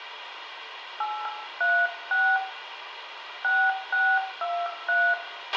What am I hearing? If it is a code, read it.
DTMF, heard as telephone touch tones, dialled by hand, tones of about 250 ms, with radio hiss, a squelch burst at the end and room echo. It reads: 836 6623